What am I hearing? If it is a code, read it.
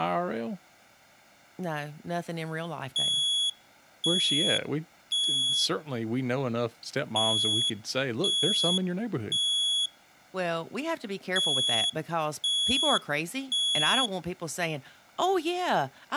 Alarm pattern, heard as an alarm's beeps, played three times, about 3350 Hz, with speech in English. Temporal three. Smoke or fire, evacuate.